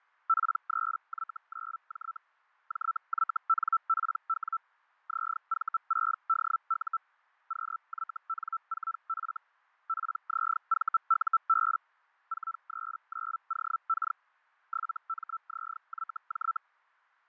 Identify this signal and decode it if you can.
Hellschreiber (Feld-Hell, 122.5 baud), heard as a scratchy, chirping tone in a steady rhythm, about 1330 Hz, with fading. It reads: P3Y9J JYNPW ZV6DU QYN4F PZVUB 439OK 7MZYJ